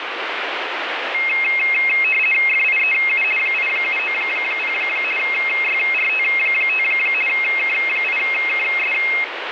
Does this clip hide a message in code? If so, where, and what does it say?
Yes: RTTY (50 baud, 450 Hz shift) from 1.1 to 9.2 s, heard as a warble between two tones, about 2350 Hz centre, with radio static. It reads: FIEU 8790 YRT5 K8KS